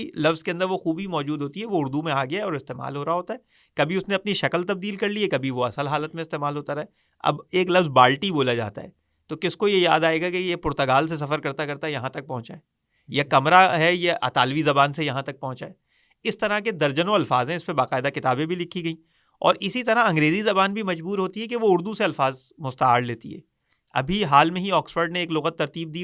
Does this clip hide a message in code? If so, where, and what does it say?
No, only speech in Urdu.